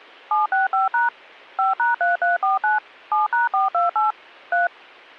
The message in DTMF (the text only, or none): 765# 5#3349 7#428 3